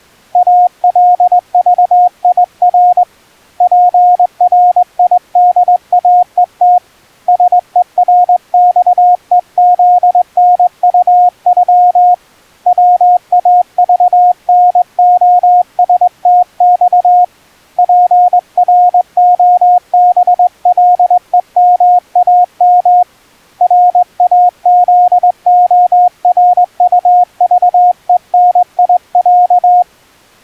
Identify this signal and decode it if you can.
Morse code (Russian alphabet), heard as a keyed tone, hand-sent with a straight key, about 21 wpm, 720 Hz. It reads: АЛЖИР ПРИДАЕТ СЕРЬЕЗНУЮ ВАЖНОСТЬ ПРОБЛЕМАМ РАЗОРУЖЕНИЯ